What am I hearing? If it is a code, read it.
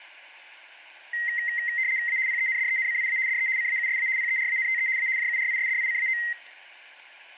RTTY (75 baud, 170 Hz shift), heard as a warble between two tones, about 2000 Hz centre. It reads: A PENDENCIA DE CAUSA PERANTE A JURISDICAO